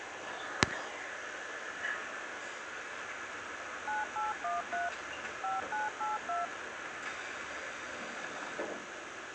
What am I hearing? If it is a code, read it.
DTMF, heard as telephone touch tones, dialled by machine, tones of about 160 ms, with radio hiss and the noise inside a subway train. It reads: 9813 5982